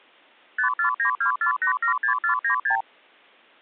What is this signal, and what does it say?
Multi-frequency trunk signalling (R2, with the far end's replies), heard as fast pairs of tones, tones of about 100 ms. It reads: 54924876496